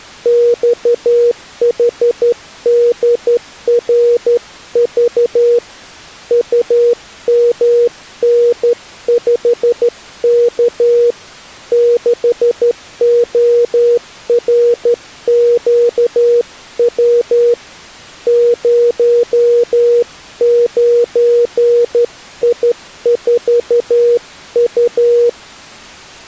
Morse code, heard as a keyed tone, hand-sent with a straight key, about 12 wpm, 480 Hz. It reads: XHDRV UMN5K 6ORQW 09I4U